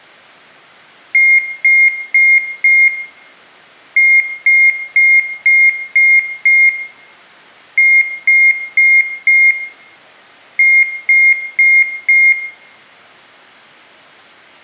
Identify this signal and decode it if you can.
Beep code, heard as beeps from a small speaker, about 2150 Hz, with room echo. 4-6-4-4.